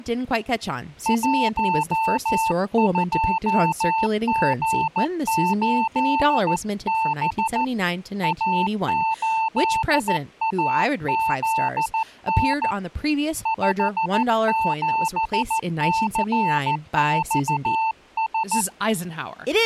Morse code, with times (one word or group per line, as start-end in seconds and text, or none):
1.1-7.6 12G8B
8.2-12.7 A8AZN
13.5-18.6 57CXS